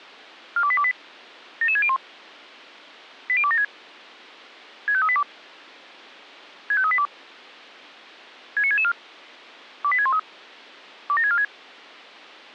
Five-tone selective call (ZVEI), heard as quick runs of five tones, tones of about 70 ms. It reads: 42828 77601 80276 65382 65382 69664 28613 27646